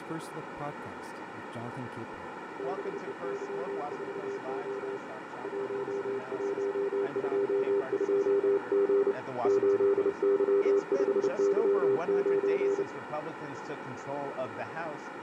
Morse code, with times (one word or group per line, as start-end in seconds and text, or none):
2.6-5.0 BEY4O
5.4-9.1 1122G
9.4-12.8 8Y5Y9